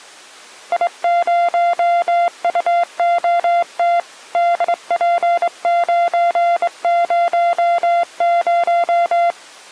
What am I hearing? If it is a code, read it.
Morse code, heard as a keyed tone, hand-sent with a straight key, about 23 wpm, 690 Hz. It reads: I0UOT DP900